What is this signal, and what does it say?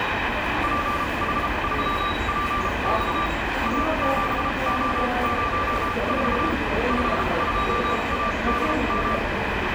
Morse code, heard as a keyed tone, machine-sent, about 33 wpm, spaced as for 27 wpm, 1180 Hz, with radio static and the noise of a subway station. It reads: PH3PX A7O04 52ADM